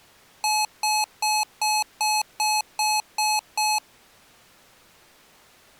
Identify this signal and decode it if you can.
Beep code, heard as beeps from a small speaker, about 850 Hz. 9 short. In AMI BIOS tables: ROM checksum failure.